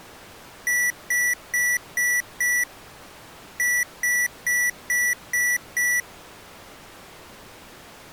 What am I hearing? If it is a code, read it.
Beep code, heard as beeps from a small speaker, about 1950 Hz. 5-6.